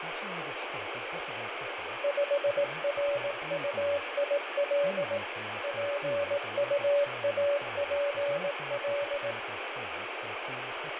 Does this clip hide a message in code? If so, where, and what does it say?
Yes: Morse code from 2.0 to 9.4 s, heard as a keyed tone, machine-sent, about 18 wpm, 570 Hz, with heavy radio static, fading and speech in English. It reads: 5RUIL PUAPL